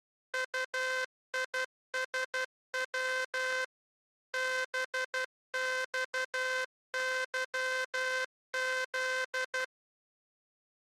Morse code, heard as a buzzer, machine-sent, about 12 wpm. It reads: UISW BXYZ